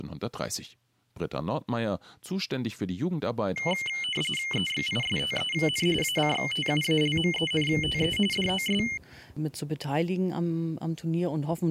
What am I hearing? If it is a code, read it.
RTTY (45.45 baud, 850 Hz shift), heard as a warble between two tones, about 2550 Hz centre. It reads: EXISTEN ACTUALMENTE DOS